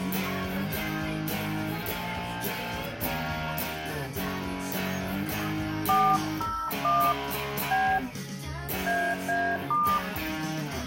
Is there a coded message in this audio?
Yes: DTMF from 5.9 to 10.0 s, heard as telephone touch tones, dialled by hand, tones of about 280 ms, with room echo. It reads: 401 B AA*